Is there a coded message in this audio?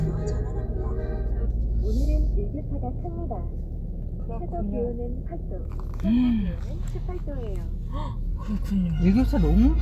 No, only the noise inside a car.